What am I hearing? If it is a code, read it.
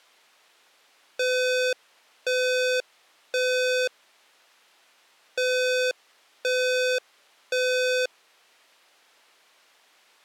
Alarm pattern, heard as an alarm's beeps, played twice, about 510 Hz. Temporal three. Smoke or fire, evacuate.